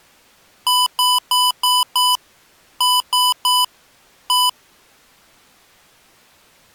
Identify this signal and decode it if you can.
Beep code, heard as beeps from a small speaker, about 1000 Hz. 5-3-1.